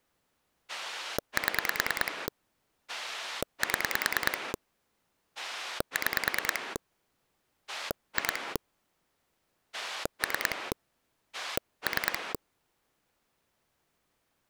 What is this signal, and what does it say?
Pulse dialling, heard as a rotary dial, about 9 pulses a second. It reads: 7 7 6 2 3 3